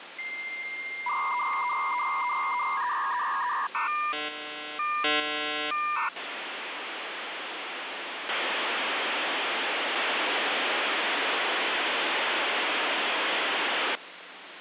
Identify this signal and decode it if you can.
Dial-up modem handshake (V.34 or later), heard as a whistle, warbles, then hiss, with phone line noise.